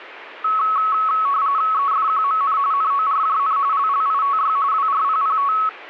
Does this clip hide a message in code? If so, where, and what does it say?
Yes: RTTY (45.45 baud, 170 Hz shift) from 0.4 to 5.7 s, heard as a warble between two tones, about 1200 Hz centre. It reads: EFQMN NORJN LLITY WRPPT